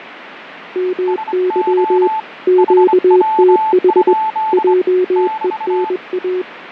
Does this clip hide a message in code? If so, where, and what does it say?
Yes: Morse code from 0.7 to 6.5 s, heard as two keyed tones, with radio static and fading. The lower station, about 21 wpm, 370 Hz: MY QTH JENA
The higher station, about 25 wpm, 880 Hz: SO HW? <BT>